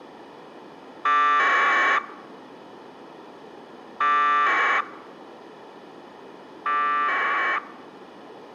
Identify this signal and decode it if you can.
Packet radio (AX.25, as in APRS), 1200 baud, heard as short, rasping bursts.